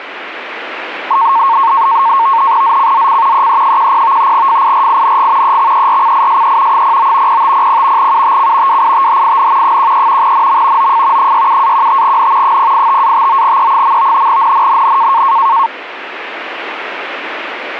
NAVTEX (SITOR-B), 100 baud, 170 Hz shift, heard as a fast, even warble, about 1000 Hz centre, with radio static. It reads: ZCZC EE10 FIRING EXERCISE 09 0500 UTC WITHIN 13 NM OF 67-15N 085-59E. NNNN